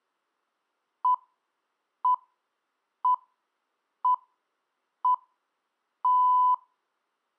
Radio time signal (six pips, as the Greenwich Time Signal), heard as pips.